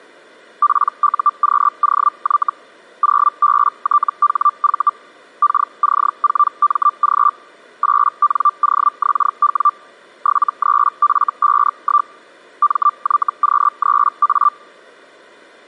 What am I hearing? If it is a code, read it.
Hellschreiber (Feld-Hell, 122.5 baud), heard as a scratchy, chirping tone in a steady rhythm, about 1180 Hz. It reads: PUQOY 0BTHV KC4MG 8NOXW 73F51 MYQ3A